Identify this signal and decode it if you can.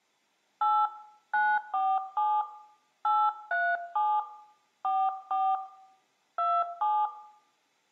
DTMF, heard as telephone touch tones, dialled by hand, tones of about 240 ms, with room echo. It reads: 8 947 837 44 27